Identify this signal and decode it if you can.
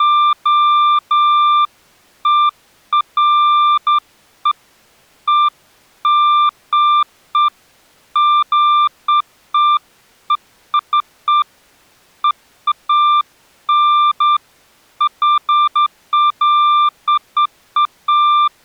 Beeps of irregular length. There is no code.